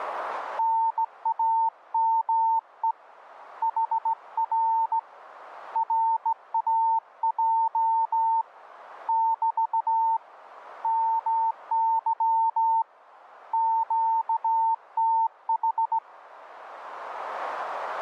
Morse code, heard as a keyed tone, hand-sent with a straight key, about 16 wpm, 900 Hz, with radio static. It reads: NAME HR RAJ <BT> MY QTH